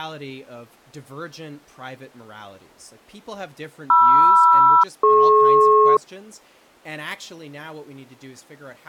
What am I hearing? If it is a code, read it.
Aircraft SELCAL, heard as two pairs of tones, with speech in English. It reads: MR-DP